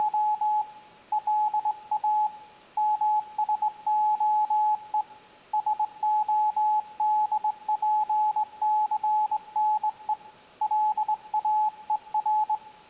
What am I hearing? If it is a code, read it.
Morse code (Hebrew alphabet), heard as a keyed tone, hand-sent with a straight key, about 21 wpm, 850 Hz, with room echo. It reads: … לא משהו שהדפסנו לאור